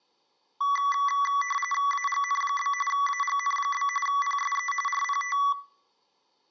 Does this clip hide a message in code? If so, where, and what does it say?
Yes: RTTY (45.45 baud, 850 Hz shift) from 0.6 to 5.5 s, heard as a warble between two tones, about 1550 Hz centre. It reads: AGN? AGN? PSE RPT